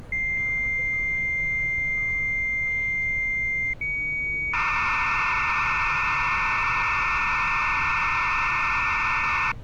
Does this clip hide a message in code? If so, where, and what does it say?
Yes: dial-up modem handshake (low-speed, two carriers) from 0.1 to 9.5 s, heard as two whistles, then hiss, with street noise.